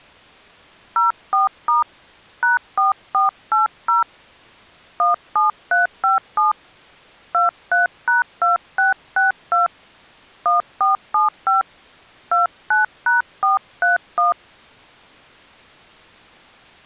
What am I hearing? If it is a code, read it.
DTMF, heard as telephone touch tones, dialled by hand, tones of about 140 ms. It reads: 04* #4480 17357 23#2662 1475 29#431